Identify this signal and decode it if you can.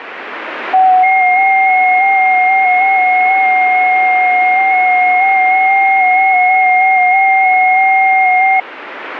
FT8 (several signals at once), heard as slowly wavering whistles, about 6.25 baud, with radio static.